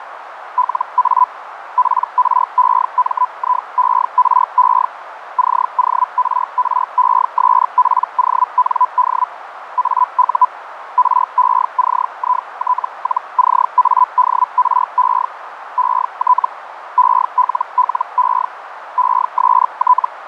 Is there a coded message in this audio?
Yes: Hellschreiber (Feld-Hell, 122.5 baud) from 0.6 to 20.1 s, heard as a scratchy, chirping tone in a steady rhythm, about 1000 Hz, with radio static and a narrow filter. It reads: LA PREMIERE CORRESPOND AU RECIT-CADRE ET ELLE EST